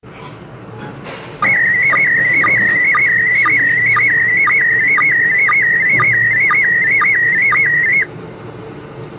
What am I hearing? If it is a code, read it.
SSTV (slow-scan television), PD 120, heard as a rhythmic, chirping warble, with the noise inside a lift.